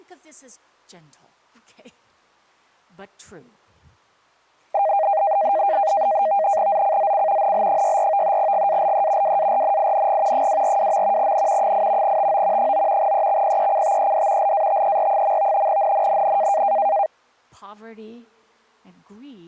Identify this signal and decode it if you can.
NAVTEX (SITOR-B), 100 baud, 170 Hz shift, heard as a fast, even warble, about 720 Hz centre. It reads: ZCZC NL64 GALE WARNING 242. N 8 TO 9 EXPECTED LATER. NNNN